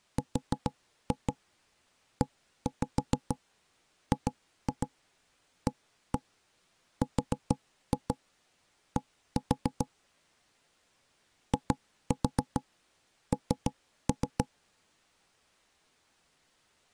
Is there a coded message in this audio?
Yes: tap code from 0.2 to 14.5 s, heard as knocks on wood, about 6 knocks a second. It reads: REGARD IN